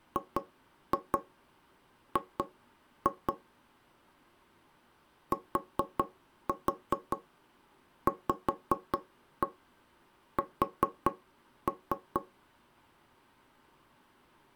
Tap code, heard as knocks on wood, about 5 knocks a second. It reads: GG TVS